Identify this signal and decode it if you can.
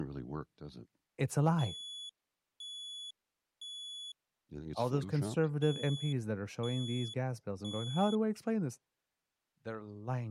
Alarm pattern, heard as an alarm's beeps, played twice, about 3400 Hz, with speech in English. Temporal three. Smoke or fire, evacuate.